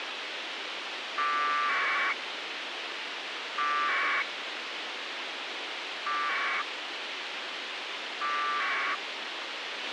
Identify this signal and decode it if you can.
Packet radio (AX.25, as in APRS), 1200 baud, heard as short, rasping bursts, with radio hiss and a squelch burst at the end.